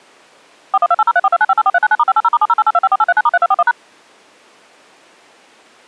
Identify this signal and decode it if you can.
DTMF, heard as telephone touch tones, dialled by machine, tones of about 40 ms. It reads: 412803429584399*580*7088254839*3241#